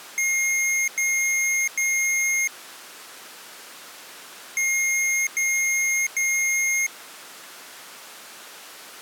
Beep code, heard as beeps from a small speaker, played twice, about 2150 Hz. 3 long. In IBM BIOS tables: keyboard card error.